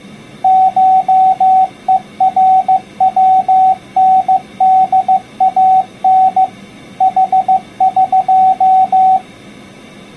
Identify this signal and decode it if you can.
Morse code (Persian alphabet), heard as a keyed tone, machine-sent, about 15 wpm, 760 Hz. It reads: شهروندان حق